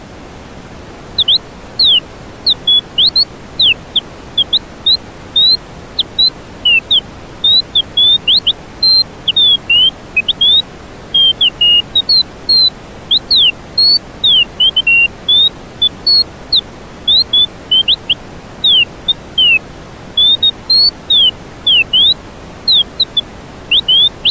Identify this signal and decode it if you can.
Bird-like chirps. There is no code.